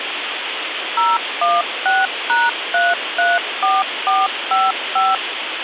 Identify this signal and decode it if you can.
DTMF, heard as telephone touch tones, dialled by machine, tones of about 200 ms, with phone line noise. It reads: 016#334455